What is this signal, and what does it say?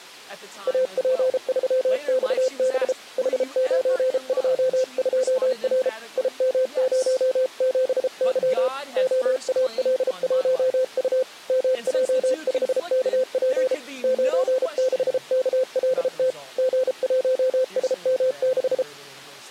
Morse code, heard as a keyed tone, hand-sent with a paddle, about 33 wpm, 520 Hz. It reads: AP3XB H922R IM07Y OAL1U MJ5KP 96KLT G1SM6